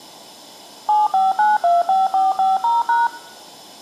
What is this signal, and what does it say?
DTMF, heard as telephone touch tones, dialled by machine, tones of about 180 ms. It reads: 75925450#